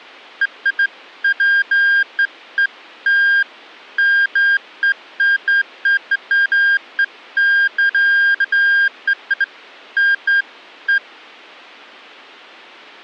Beeps of irregular length. There is no code.